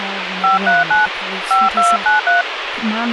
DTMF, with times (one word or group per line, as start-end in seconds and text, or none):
0.4-1.1 539
1.5-2.4 5293